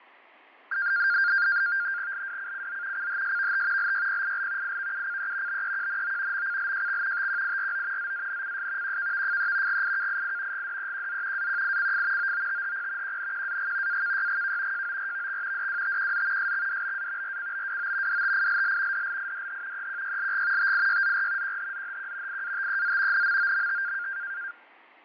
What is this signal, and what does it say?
NAVTEX (SITOR-B), 100 baud, 170 Hz shift, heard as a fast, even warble, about 1500 Hz centre, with fading. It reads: LWCCZ CHSVT LYPIL IVUCE BEQNO MCLJX TQIRO ZANCS QKVFE GIKII GDEQZ AQICF OOTHP QNQAG AKYGK JORVX DWTQZ SXDBA RCBWO DTILL DLIDH EQYLG TIYZR QHZHQ IATEZ NMOMT